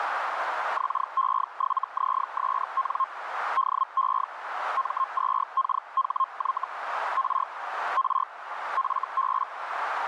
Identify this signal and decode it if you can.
Hellschreiber (Feld-Hell, 122.5 baud), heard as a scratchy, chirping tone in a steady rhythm, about 1060 Hz, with radio static and a narrow filter. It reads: XE7ZSN DE M2KHY R R FB